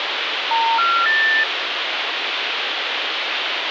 Telephone call progress tone (North American plan), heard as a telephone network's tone, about 910, 1370, 1800 Hz, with phone line noise. Special information tone.